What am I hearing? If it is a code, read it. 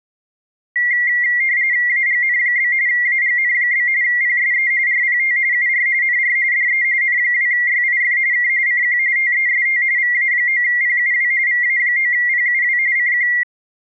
RTTY (45.45 baud, 170 Hz shift), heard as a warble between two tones, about 2050 Hz centre. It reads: AGN? AGN? PSE RPT UR NR DE N2YIF K CQ TEST VA9PUW VA9PUW CQ